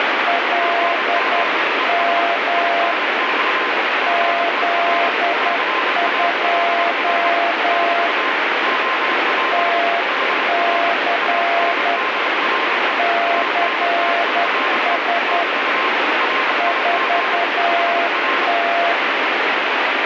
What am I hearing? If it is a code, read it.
Morse code, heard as two keyed tones, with heavy radio static. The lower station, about 10 wpm, 690 Hz: LM Z2 TC CS 4T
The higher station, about 26 wpm, 1040 Hz: GM ES TNX FER CALL <BT> OP HR ANDRE ANDRE <BT> RIG HR